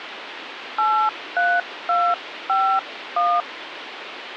DTMF, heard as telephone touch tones, dialled by hand, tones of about 260 ms, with phone line noise. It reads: 83251